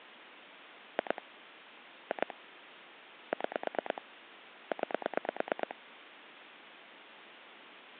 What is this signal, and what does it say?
Pulse dialling, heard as clicks on a phone line, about 9 pulses a second, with phone line noise. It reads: 2 2 6 9